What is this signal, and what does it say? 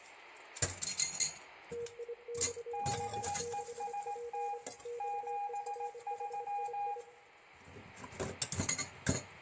Morse code, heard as two keyed tones, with room echo and kitchen noise. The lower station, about 25 wpm, 480 Hz: TIXD6P XERHII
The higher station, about 18 wpm, 810 Hz: BEST 73